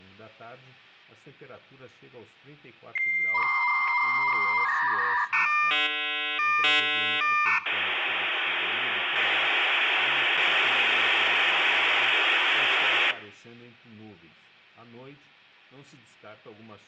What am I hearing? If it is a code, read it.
Dial-up modem handshake (V.34 or later), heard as a whistle, warbles, then hiss, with hum and room echo.